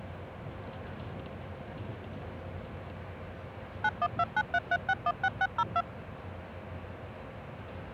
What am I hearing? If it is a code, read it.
DTMF, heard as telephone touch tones, dialled by machine, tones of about 50 ms, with the noise inside a bus. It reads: 912933616602